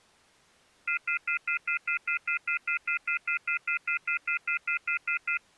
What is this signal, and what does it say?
Telephone call progress tone (North American plan), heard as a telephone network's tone, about 1400, 2050, 2450, 2600 Hz, 0.1 s on and 0.1 s off. Off-hook warning tone.